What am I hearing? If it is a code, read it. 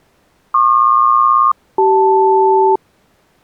Aircraft SELCAL, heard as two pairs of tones. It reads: PQ-CL